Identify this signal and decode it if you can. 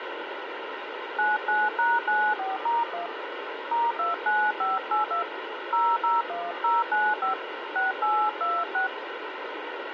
DTMF, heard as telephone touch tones, dialled by hand, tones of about 200 ms, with radio hiss. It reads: 99#94*1 *29582 001095 6826